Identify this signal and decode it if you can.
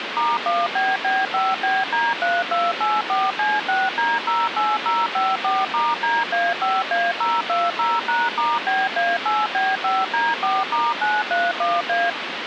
DTMF, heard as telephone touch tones, dialled by machine, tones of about 210 ms, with phone line noise. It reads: *1BB5BD3284C6D08054*DA5A020#*BA8B5D4*931A